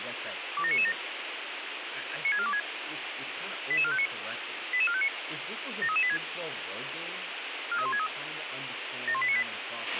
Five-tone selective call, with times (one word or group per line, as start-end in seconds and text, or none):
0.6-0.9 27997
2.2-2.6 96426
3.7-4.1 88459
4.7-5.1 88459
5.8-6.2 73386
7.7-8.1 43163
9.1-9.4 71898